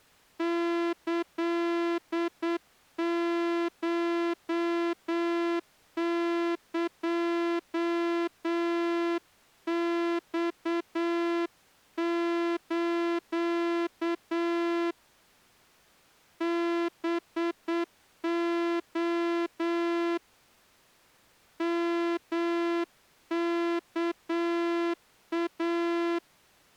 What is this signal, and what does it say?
Morse code (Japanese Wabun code), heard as a horn, hand-sent with a straight key, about 8 wpm. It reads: キコエマス ハレ ヨワイ